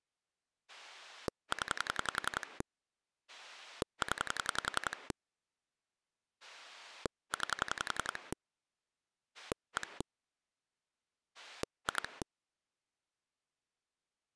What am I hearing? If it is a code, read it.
Pulse dialling, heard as a rotary dial, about 11 pulses a second. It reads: 0 0 9 1 2